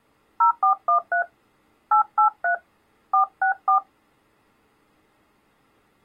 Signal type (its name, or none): DTMF